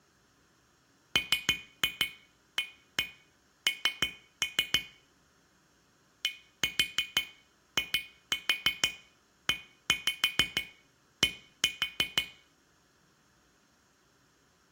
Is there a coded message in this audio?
Yes: tap code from 1.2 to 12.3 s, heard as taps on glass, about 6 knocks a second, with room echo. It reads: MAN DIED